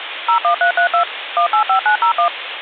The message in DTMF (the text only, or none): 01332 185901